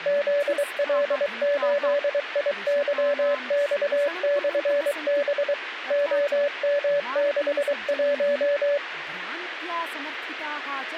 Morse code, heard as a keyed tone, machine-sent, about 23 wpm, 570 Hz, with radio hiss and speech in Sanskrit. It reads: ZL8IYX/B OM61